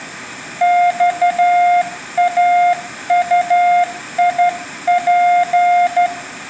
Morse code, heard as a keyed tone, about 12 wpm, 710 Hz, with room echo. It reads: XAUIP